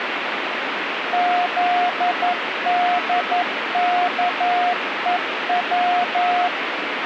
Morse code, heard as a keyed tone, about 11 wpm, 710 Hz, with radio static. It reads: ZDKEW